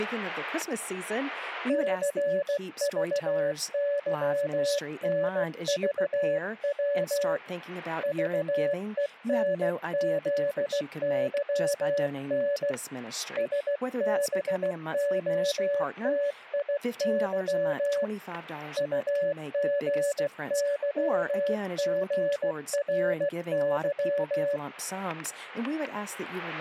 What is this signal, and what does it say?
Morse code, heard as a keyed tone, hand-sent with a paddle, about 16 wpm, 570 Hz, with static crashes and speech in English. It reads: CVYNVW VENZYN SBOTIY UGYGRY